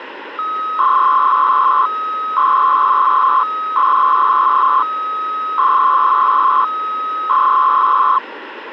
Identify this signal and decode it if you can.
300-baud modem data (Bell 103 tones), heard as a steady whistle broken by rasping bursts, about 300 baud, 200 Hz shift, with phone line noise.